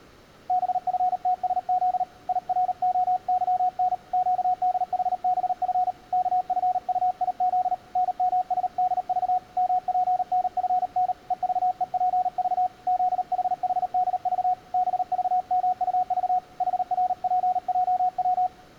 Morse code, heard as a keyed tone, hand-sent with a paddle, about 38 wpm, 730 Hz. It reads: BFTSZ IROYN QDHBF KFUIZ NMSDV MPNFN EVEPV ZHHDV BVMUV HRPJW